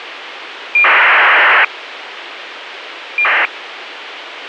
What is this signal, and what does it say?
ACARS aircraft data, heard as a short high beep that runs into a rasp, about 2400 baud, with radio hiss.